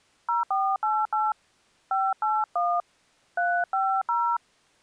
DTMF, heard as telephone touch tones, dialled by hand, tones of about 230 ms. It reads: 0488 581 350